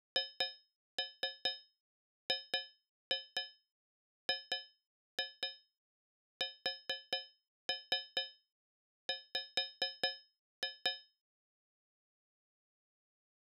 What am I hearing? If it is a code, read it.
Tap code, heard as taps on a metal pipe, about 4 knocks a second. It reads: HGGSW